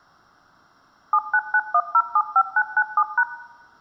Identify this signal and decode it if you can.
DTMF, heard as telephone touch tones, dialled by machine, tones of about 60 ms, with room echo. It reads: 7991075997#